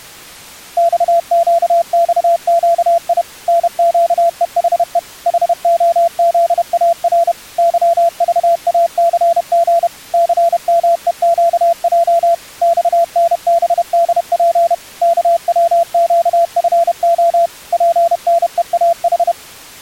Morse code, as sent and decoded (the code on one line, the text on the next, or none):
-..- --.- -..- --.- .. / -. --.- . .... . / .... --- --.. .- .-. / -.-- ...- .- -.-. --. / -.-. -- . --.- .--- / -..- -. -... -.. .--. / -.- .-- --.- ..-. --- / .--. -. . .- ....
XQXQI NQEHE HOZAR YVACG CMEQJ XNBDP KWQFO PNEAH